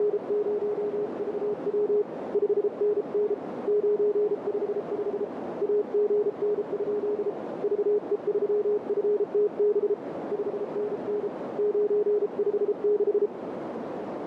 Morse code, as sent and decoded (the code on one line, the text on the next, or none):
… / ..... -. -. / ----. ..... ..... / .- --. -. ..--.. / ...- . ...-- ..-. - -... / ..... -. -. / ----. ..... -....
… 5NN 955 AGN? VE3FTB 5NN 956